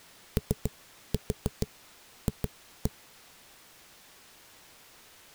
Tap code, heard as knocks on a wall, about 7 knocks a second. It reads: OF